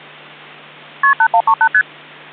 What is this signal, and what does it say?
Multi-frequency trunk signalling (R1, as on North American trunks), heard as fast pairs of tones, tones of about 70 ms, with hum. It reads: KP 8138 ST